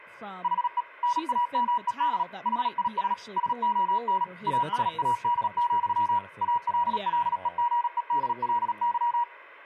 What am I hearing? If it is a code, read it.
Morse code, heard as a keyed tone, machine-sent, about 37 wpm, 960 Hz, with speech in English. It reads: HE NAMED HIS SON ASAD, ALLEGEDLY